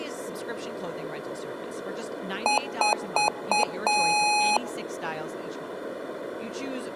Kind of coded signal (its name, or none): beep code